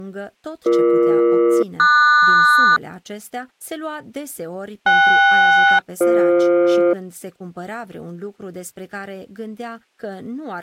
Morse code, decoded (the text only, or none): none